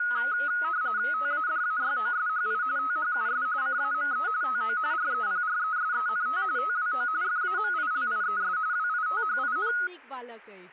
RTTY (45.45 baud, 170 Hz shift), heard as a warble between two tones, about 1360 Hz centre, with speech in Maithili. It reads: TADAYOSHI THUS CAME TO REPRESENT TWO FAMILIES WITHIN